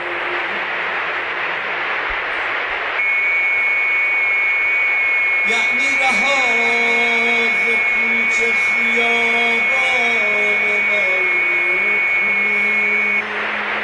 FT8 (several signals at once), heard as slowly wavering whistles, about 6.25 baud, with radio static.